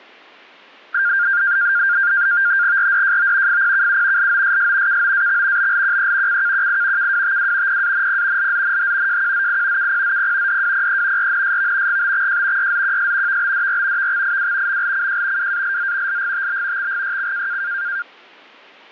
NAVTEX (SITOR-B), 100 baud, 170 Hz shift, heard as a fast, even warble, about 1500 Hz centre. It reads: RDJO FPKU LOSS KOAX BLQE CKQI KWTW PANP LZNH JQZI KPZP DWPE RNSV GBXJ YZQS VBDR VXIW MLCJ WALZ LGTB XGYC